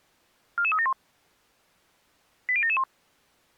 Five-tone selective call (ZVEI), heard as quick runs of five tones, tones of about 70 ms. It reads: 44371 80771